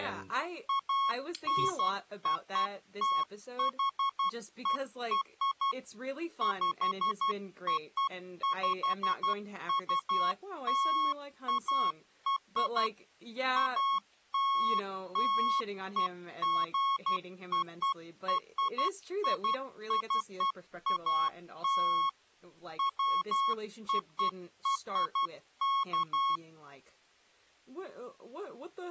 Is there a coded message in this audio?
Yes: Morse code (American railroad code) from 0.6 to 26.4 s, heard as a keyed tone, machine-sent, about 1100 Hz, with speech in English. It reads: ANOTHER POPULAR ALLEGORICAL WORK